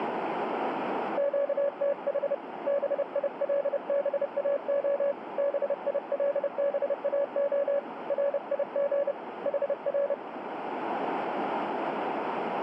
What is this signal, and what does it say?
Morse code, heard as a keyed tone, hand-sent with a paddle, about 30 wpm, 560 Hz, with radio static and a narrow filter. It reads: QTH BILBAO BILBAO RIG HR